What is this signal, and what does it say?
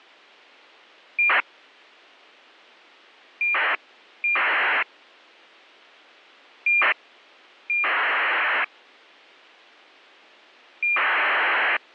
ACARS aircraft data, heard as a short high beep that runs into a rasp, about 2400 baud.